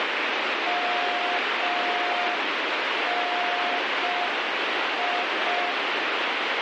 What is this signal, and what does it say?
Morse code, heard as a keyed tone, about 5 wpm, 710 Hz, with heavy radio static. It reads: MNI